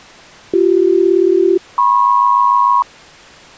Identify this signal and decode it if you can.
Aircraft SELCAL, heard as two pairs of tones. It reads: BC-MP